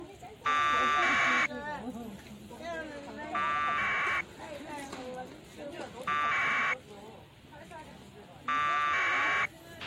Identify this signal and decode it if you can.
Packet radio (AX.25, as in APRS), 1200 baud, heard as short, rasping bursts, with a squelch burst at the end and the noise of a residential street.